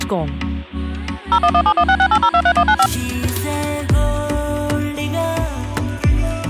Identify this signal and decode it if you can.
DTMF, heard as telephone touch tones, dialled by machine, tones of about 70 ms. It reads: 01171668023195